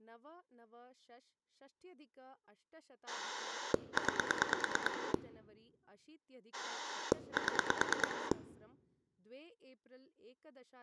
Pulse dialling, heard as a rotary dial, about 9 pulses a second, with speech in Sanskrit. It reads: 9 7